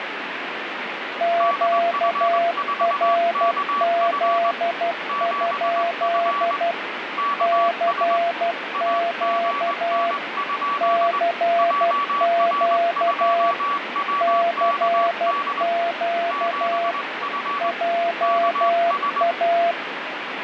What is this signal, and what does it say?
Morse code, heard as two keyed tones, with radio static. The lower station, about 12 wpm, 680 Hz: QRZ? CQ CQ CQ JA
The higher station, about 21 wpm, 1140 Hz: DF4KF 7F KS AGN? JR2WKD 7F KS